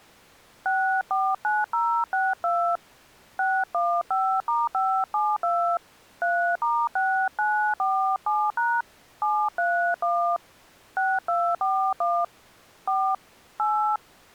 DTMF, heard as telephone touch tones, dialled by hand, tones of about 280 ms. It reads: 649062 615*572 3*6947# 731 6241 4 8